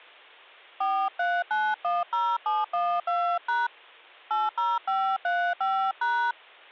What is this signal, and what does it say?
DTMF, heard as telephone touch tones, dialled by hand, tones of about 250 ms. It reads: 43910712# 80535#